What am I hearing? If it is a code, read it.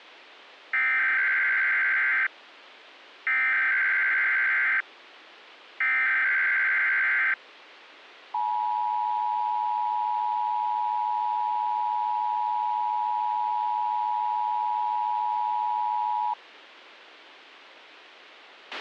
Emergency Alert System (SAME) tones (header bursts, then the 853 and 960 Hz attention tone), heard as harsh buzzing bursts, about 520.83 baud, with a squelch burst at the end.